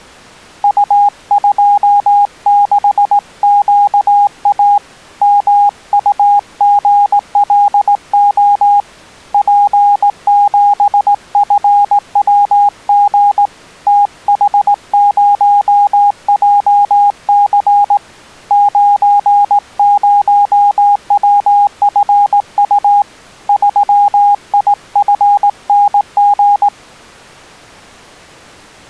Morse code, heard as a keyed tone, hand-sent with a straight key, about 18 wpm, 820 Hz. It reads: U26QA MUGLO P7FWG TH0JC 90WFU 3IFNG